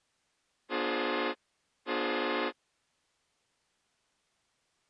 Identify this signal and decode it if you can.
Train horn signal, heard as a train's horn. 2 short. On North American railways: a signal is acknowledged.